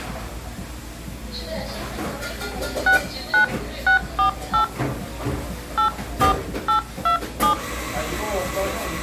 DTMF, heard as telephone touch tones, dialled by hand, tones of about 110 ms, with the noise of a cafe. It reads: 69648 84827